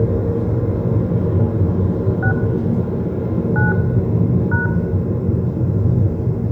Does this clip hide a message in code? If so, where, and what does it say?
Yes: DTMF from 2.2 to 4.7 s, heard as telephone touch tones, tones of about 130 ms, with room echo and the noise inside a car. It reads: 6 9 #